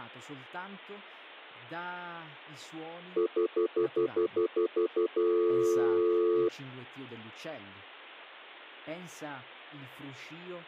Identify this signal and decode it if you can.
Telephone call progress tone (North American plan), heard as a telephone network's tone, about 350, 440 Hz, 0.1 s on and 0.1 s off, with speech in Italian. Stutter dial tone.